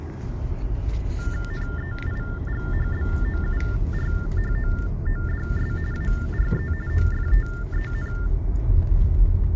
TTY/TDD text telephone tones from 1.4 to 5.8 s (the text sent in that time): NEIGHBOURHOODS